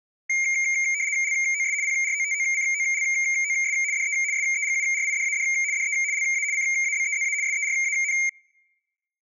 RTTY (75 baud, 170 Hz shift), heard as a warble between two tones, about 2200 Hz centre. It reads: LOS PROTOCOLOS DE SEGURIDAD DE LA CABEZA SERAN